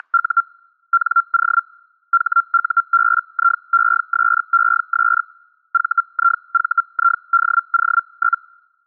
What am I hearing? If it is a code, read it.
Hellschreiber (Feld-Hell, 122.5 baud), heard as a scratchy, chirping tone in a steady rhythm, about 1370 Hz. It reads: … NO HUBIESES VIVIDO?